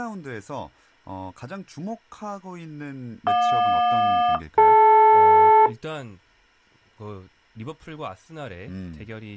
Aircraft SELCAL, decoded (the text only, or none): JQ-DL